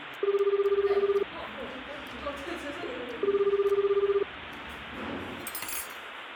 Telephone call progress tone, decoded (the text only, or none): ringback tone